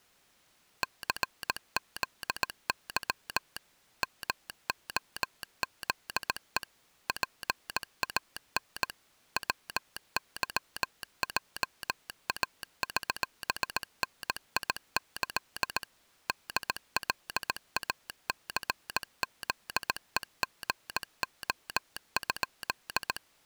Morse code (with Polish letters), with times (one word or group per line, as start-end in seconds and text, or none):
0.8-3.6 CZY
4.0-6.6 MOZE
7.1-8.9 PAN
9.4-15.8 WYJAŚNIĆ
16.3-23.2 DLACZEGO?